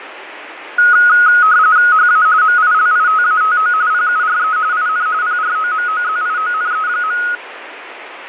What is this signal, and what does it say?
RTTY (45.45 baud, 170 Hz shift), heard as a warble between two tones, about 1360 Hz centre, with radio static. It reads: HA MILITATO PURE IN PROMOZIONE.